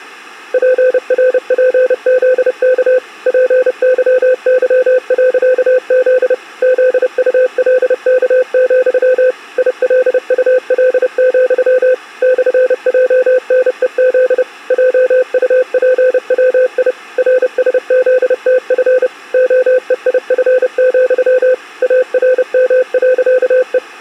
Morse code, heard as a keyed tone, machine-sent, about 30 wpm, 510 Hz. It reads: PRPZK PYY.Z ZULK, ILUL, /JNEZ JUPWI RSZTF OEIF, ARM.E